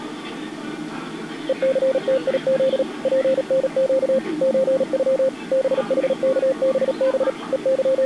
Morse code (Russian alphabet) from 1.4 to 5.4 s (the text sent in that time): ЕЦТИЗ ПНЩ ЧЮ